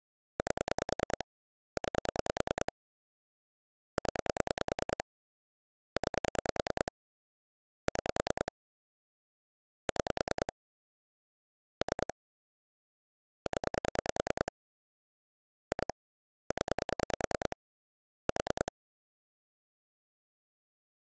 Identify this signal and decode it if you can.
Pulse dialling, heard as clicks on a phone line, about 10 pulses a second. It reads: 8 9 0 9 6 6 3 0 2 0 4